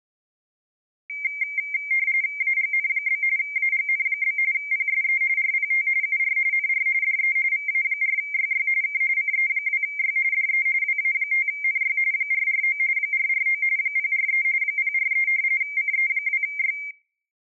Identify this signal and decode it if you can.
RTTY (45.45 baud, 170 Hz shift), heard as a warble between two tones, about 2200 Hz centre. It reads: AGN? AGN? PSE RPT UR NR DE VA4YY K CE2Y DE WA5NY 449 449 043 043 CE2Y